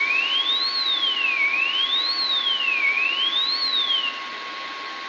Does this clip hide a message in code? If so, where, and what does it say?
No, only a tone that sweeps in pitch again and again, with radio static, a steady whistle near 1090 Hz and room echo.